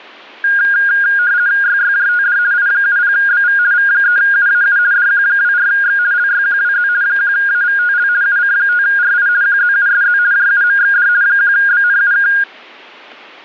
RTTY (50 baud, 170 Hz shift), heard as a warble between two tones, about 1550 Hz centre, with static crashes. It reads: YYJTD I70BV V3UAU DQ24X LYQWZ 1AVTL UC5RI QZUSZ JUMXD 1BNUK